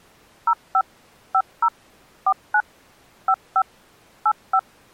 DTMF, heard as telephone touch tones, dialled by machine, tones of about 60 ms. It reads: 05 50 49 55 85